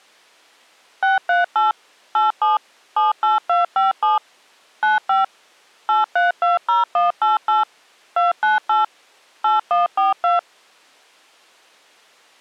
DTMF, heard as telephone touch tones, dialled by machine, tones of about 150 ms. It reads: 638 87 78257 95 8320188 298 8142